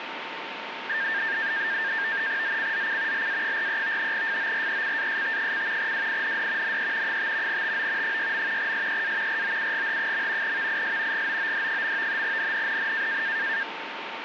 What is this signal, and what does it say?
NAVTEX (SITOR-B), 100 baud, 170 Hz shift, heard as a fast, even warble, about 1700 Hz centre, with radio static and a steady whistle near 910 Hz. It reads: ZCZC LA43 FORECAST: WIND NE 5 TO 6. SEA ROUGH. VIS GOOD. NNNN